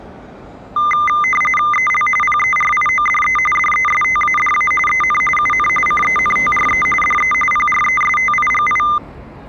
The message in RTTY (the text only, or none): EL PERIODE DESTADA EN UN CENTRE DE PRESTIGI